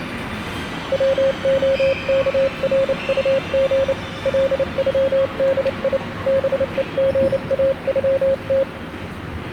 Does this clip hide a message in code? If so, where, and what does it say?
Yes: Morse code (Russian alphabet) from 0.9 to 8.7 s, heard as a keyed tone, hand-sent with a paddle, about 29 wpm, 540 Hz, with the noise of a subway station. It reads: ВОКРУГ ЛЮДИ БЕГАЮТ